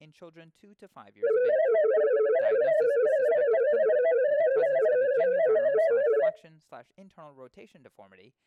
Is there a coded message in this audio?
Yes: multi-tone FSK (Olivia or MFSK type), about 250 Hz wide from 1.2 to 6.3 s, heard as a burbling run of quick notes, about 31.25 baud, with speech in English.